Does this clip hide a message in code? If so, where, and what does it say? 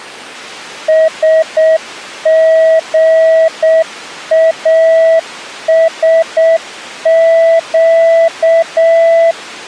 Yes: Morse code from 0.8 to 9.4 s, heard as a keyed tone, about 7 wpm, 650 Hz. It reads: SGASQ